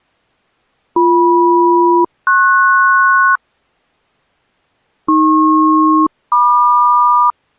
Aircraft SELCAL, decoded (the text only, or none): BM-PS AP-MQ